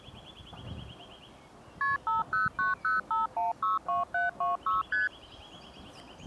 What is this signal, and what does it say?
Multi-frequency trunk signalling (R1, as on North American trunks), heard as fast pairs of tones, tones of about 150 ms. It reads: KP 50905162726 ST